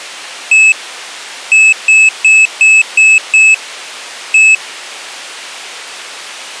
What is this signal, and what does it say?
Beep code, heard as a piezo beeper, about 2600 Hz. 1-6-1.